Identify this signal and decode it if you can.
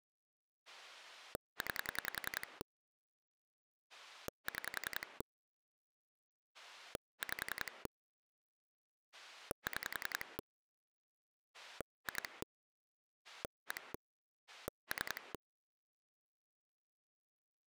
Pulse dialling, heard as a rotary dial, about 10 pulses a second. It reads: 9 6 5 6 2 1 3